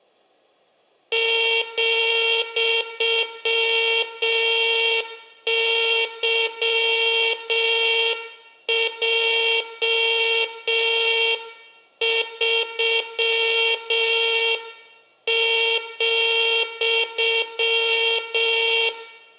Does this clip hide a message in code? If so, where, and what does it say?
Yes: Morse code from 1.1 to 18.9 s, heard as a buzzer, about 6 wpm, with room echo. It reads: ,YJ3,